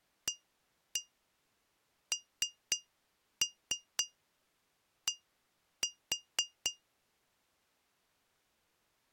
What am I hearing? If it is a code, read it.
Tap code, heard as taps on glass, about 4 knocks a second. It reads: AND